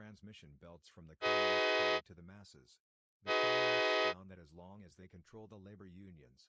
Train horn signal, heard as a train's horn, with speech in English. 2 short. On North American railways: a signal is acknowledged.